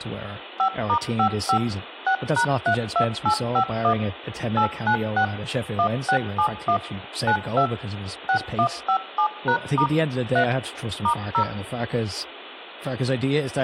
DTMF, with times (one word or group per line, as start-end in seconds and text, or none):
0.6-1.6 5*55
2.1-3.9 6#32851
4.6-5.2 896
5.8-6.8 1671
7.3-7.7 92
8.3-9.9 6157#*
10.4-10.4 3
11.0-11.4 *0